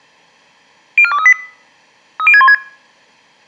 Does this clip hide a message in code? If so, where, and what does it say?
Yes: five-tone selective call (ZVEI) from 1.0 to 2.5 s, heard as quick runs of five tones, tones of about 70 ms. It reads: 04238 30616